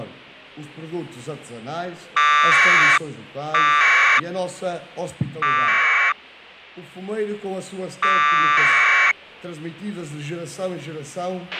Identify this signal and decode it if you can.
Packet radio (AX.25, as in APRS), 1200 baud, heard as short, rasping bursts, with a squelch burst at the end.